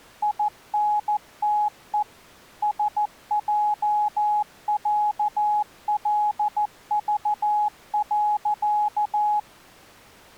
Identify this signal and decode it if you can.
Morse code (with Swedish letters), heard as a keyed tone, machine-sent, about 14 wpm, 840 Hz. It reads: INTE SJÄLV.